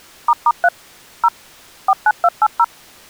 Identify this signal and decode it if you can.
DTMF, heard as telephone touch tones, dialled by machine, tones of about 50 ms. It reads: **3 0 49280